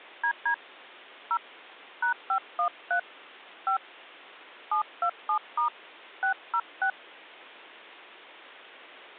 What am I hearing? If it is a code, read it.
DTMF, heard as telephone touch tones, dialled by hand, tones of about 90 ms. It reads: DD 0 #513 5 727* 606